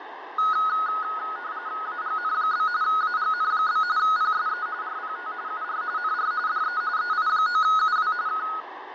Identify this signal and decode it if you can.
RTTY (45.45 baud, 170 Hz shift), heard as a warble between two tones, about 1360 Hz centre, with radio static and fading. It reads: AGN? AGN? PSE RPT UR NR DE EI9UW K